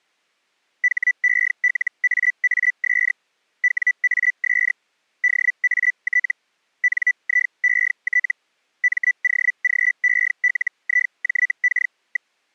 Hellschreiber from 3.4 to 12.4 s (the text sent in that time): WAS DAT NIET MOGELIJK.